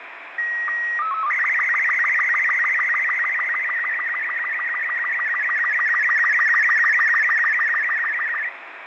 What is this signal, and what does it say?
SSTV (slow-scan television), Robot 36, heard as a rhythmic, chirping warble, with radio static and fading.